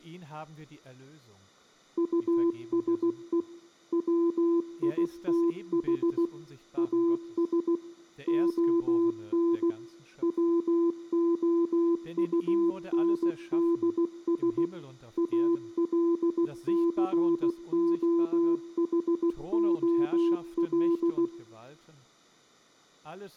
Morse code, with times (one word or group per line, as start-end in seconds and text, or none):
2.0-3.4 USE
3.9-6.3 WITH
6.8-7.8 AS
8.3-9.7 ON
10.2-14.7 WOUNDS
15.2-21.3 ALCOHOL